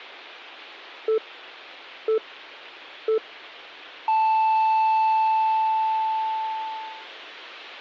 Radio time signal (three low pips and a long one an octave up, as on NHK), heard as pips.